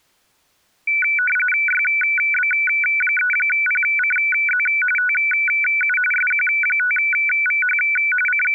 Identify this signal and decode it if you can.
RTTY (45.45 baud, 850 Hz shift), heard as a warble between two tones, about 1900 Hz centre. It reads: YB3PCZ TU SQ5VH …